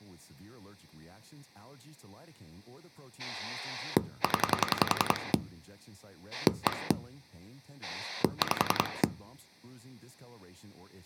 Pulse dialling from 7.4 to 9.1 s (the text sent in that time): 5